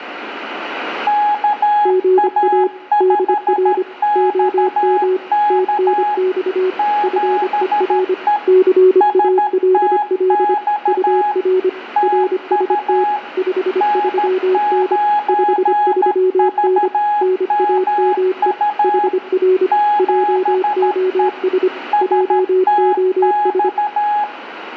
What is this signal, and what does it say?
Morse code, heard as two keyed tones, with radio static and room echo. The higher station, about 13 wpm, 830 Hz: KA5XK 7E STX TU N9VMU 7E STX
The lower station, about 25 wpm, 370 Hz: GA DR OM TNX FER CALL UR RST 53N 53N NAME HR JOS JOS